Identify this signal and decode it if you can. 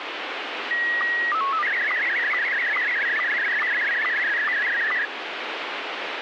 SSTV (slow-scan television), Scottie S1, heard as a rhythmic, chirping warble, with radio static.